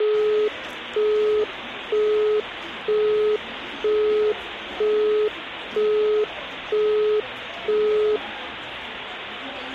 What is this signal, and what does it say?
Telephone call progress tone (single-tone plan, as in Europe, Japan and elsewhere), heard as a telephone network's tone, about 420 Hz, 0.48 s on and 0.48 s off, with the noise of a crowd indoors. Busy tone.